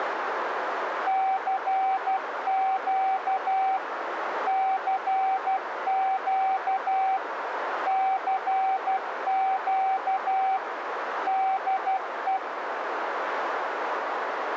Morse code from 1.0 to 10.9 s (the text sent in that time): CQ CQ CQ